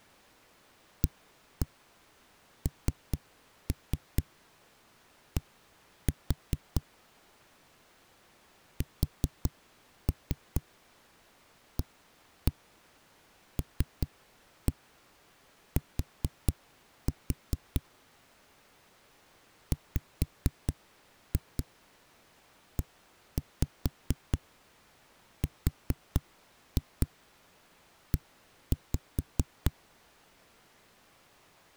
Tap code, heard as knocks on a wall, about 4 knocks a second. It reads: AND SALT WERE